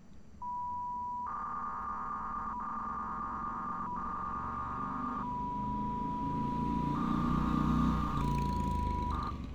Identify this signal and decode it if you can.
300-baud modem data (V.21 tones), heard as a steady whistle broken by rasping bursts, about 300 baud, 200 Hz shift, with street noise.